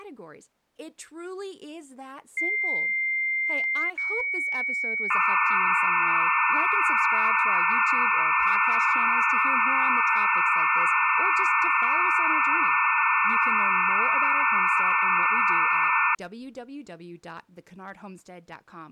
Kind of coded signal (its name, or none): dial-up modem handshake